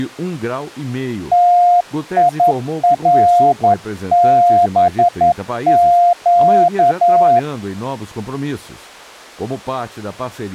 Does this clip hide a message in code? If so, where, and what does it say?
Yes: Morse code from 1.3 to 7.5 s, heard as a keyed tone, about 11 wpm, 700 Hz. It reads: TIRBQ